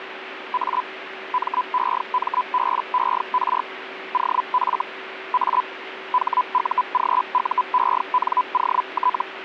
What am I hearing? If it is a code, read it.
Hellschreiber (Feld-Hell, 122.5 baud), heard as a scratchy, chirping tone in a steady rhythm, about 1000 Hz, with radio static and a steady whistle near 380 Hz. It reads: A MEMBER OF A HUGUENOT